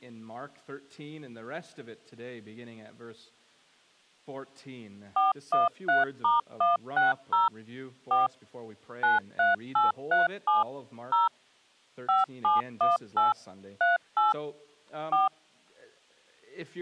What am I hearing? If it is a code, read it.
DTMF, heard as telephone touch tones, dialled by machine, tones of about 160 ms. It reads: 413*160 4 93837 0 5718 38 4